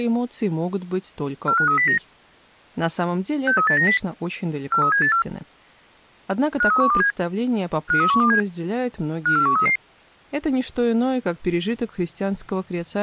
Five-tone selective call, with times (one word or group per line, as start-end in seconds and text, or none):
1.5-2.0 45309
3.5-4.0 63890
4.7-5.2 43784
6.6-7.1 53127
7.9-8.4 53127
9.3-9.8 54133